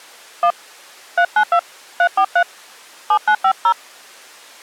DTMF, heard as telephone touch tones, dialled by hand, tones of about 80 ms. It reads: 1 392 343 7950